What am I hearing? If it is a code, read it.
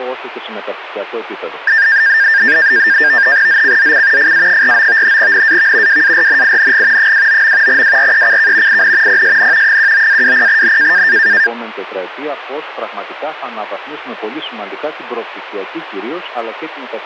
NAVTEX (SITOR-B), 100 baud, 170 Hz shift, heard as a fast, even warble, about 1700 Hz centre. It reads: ZCZC FA49 NAV WARNING 29. WRECK IN PSN 19-20N